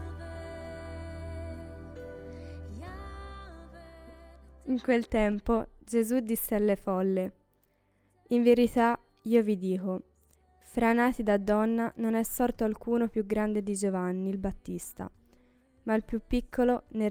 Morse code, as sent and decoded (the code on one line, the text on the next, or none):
none